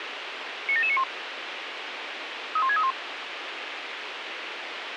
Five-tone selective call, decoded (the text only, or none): 97791 31631